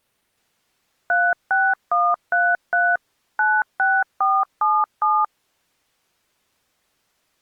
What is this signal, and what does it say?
DTMF, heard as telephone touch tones, dialled by machine, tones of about 230 ms. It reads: 36133 96477